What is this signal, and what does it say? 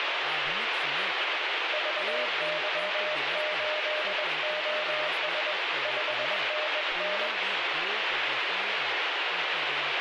Morse code, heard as a keyed tone, hand-sent with a bug key, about 21 wpm, 610 Hz, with heavy radio static and speech in Dogri. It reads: VY8OS 5NN